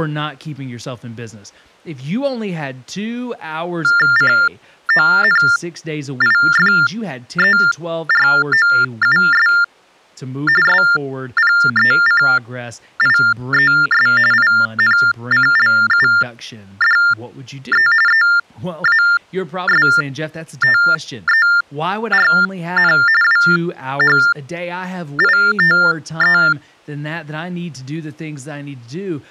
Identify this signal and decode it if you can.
TTY/TDD text telephone tones (45.45 baud Baudot), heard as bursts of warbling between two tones, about 400 Hz shift, 1600 Hz centre, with speech in English. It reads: CONIFEROUS SPECIES INCLUDE EASTERN WHITE